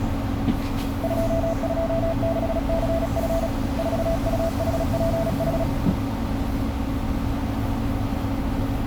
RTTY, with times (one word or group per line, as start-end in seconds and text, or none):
none